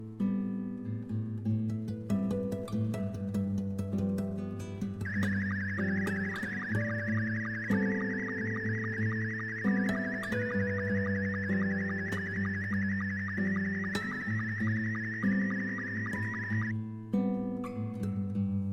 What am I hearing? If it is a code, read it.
SSTV (slow-scan television), Scottie S2, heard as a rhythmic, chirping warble.